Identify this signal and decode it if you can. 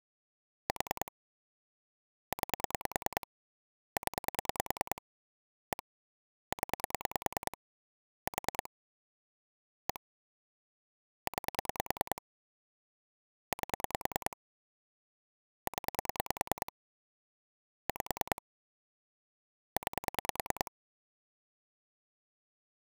Pulse dialling, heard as clicks on a phone line, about 10 pulses a second. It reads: 4 9 0 1 0 4 1 9 8 0 5 9